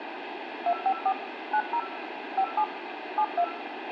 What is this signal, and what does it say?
DTMF, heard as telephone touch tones, dialled by machine, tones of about 70 ms, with radio hiss and a squelch burst at the end. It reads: 254 90 57 72